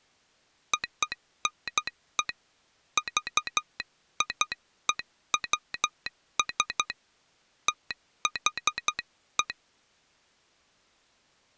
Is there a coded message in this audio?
Yes: Morse code (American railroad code) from 0.7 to 9.6 s, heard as a telegraph sounder, hand-sent with a straight key. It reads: ONE VIEWS THE